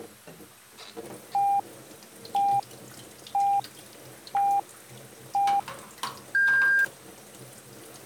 Radio time signal (five pips and a higher one, as on Chinese radio), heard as pips, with kitchen noise.